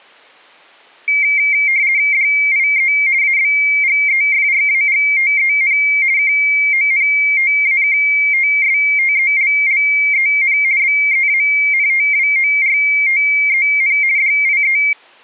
RTTY (50 baud, 170 Hz shift), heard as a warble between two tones, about 2200 Hz centre. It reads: DIE ABGEFRAGTEN KONTAKTSTELLEN BEANTWORTEN DIE